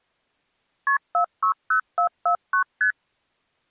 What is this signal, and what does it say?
Multi-frequency trunk signalling (R1, as on North American trunks), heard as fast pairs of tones, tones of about 100 ms. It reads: KP 460449 ST